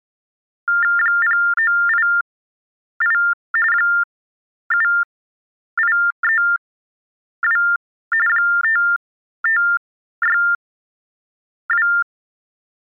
TTY/TDD text telephone tones (45.45 baud Baudot), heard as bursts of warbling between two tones, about 400 Hz shift, 1600 Hz centre. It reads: 0988 7832 5562